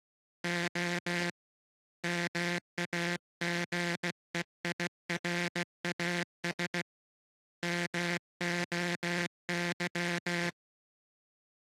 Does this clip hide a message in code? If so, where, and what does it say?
Yes: Morse code (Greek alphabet) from 0.4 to 10.6 s, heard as a buzzer, hand-sent with a paddle, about 16 wpm. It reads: Ο ΜΑΓΕΙΡΑΣ ΜΟΥ